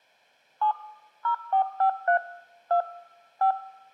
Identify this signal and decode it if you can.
DTMF, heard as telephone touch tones, dialled by machine, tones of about 100 ms. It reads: 7 0453 2 5